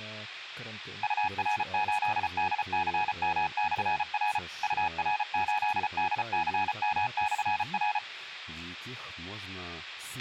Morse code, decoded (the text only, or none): UR8DCM/R UR8DCM/R